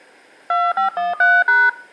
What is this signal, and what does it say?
DTMF, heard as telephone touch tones, dialled by hand, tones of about 170 ms, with room echo. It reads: 2513#